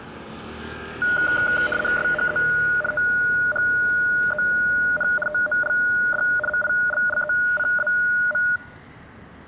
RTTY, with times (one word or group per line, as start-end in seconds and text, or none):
2.0-2.4 SHE
2.9-5.1 THEN
5.3-6.2 TOLD
6.5-8.4 MILLECAM